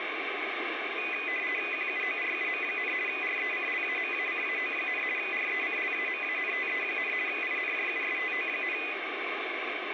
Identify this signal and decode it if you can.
RTTY (50 baud, 450 Hz shift), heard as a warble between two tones, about 2250 Hz centre, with radio static. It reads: QUORUM, RECLAMACAO, RECLAMANTE, INJUSTO,